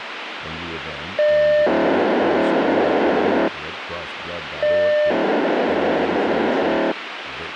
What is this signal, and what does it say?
POCSAG pager data (1200 baud), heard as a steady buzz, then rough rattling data, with radio hiss and speech in English.